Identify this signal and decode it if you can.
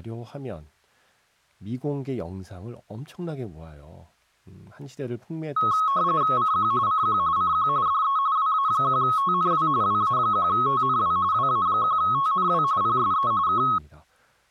RTTY (45.45 baud, 170 Hz shift), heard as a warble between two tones, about 1190 Hz centre, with speech in Korean. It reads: CQ CQ CQ DE WA1TNW WA1TNW WA1TNW PSE K